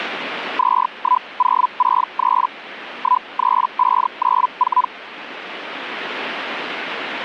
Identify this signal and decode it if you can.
Hellschreiber (Feld-Hell, 122.5 baud), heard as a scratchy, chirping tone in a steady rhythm, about 1000 Hz. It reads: 21063 13594